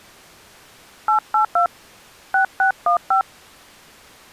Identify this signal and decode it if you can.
DTMF, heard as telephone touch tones, dialled by hand, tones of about 110 ms. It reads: 882 6615